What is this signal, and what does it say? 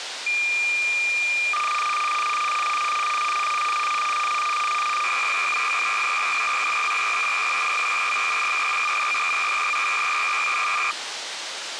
Cassette data (Kansas City type), 300 baud, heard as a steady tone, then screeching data, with tape hiss.